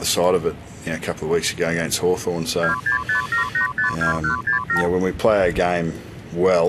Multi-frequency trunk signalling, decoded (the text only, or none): 2657852167